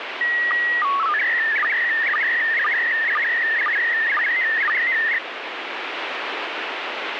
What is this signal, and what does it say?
SSTV (slow-scan television), PD 120, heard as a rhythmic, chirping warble, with radio static.